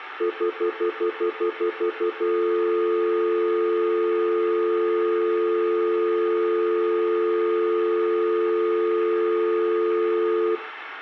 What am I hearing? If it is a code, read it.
Telephone call progress tone (North American plan), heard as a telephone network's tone, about 350, 440 Hz, 0.1 s on and 0.1 s off, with room echo. Stutter dial tone.